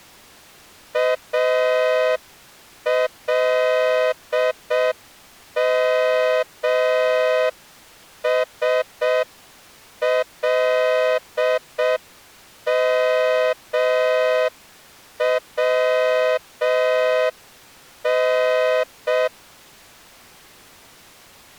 Morse code (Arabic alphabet), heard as a horn, hand-sent with a straight key, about 6 wpm. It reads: المسلمون